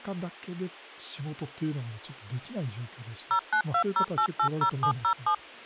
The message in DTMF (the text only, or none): 0920880707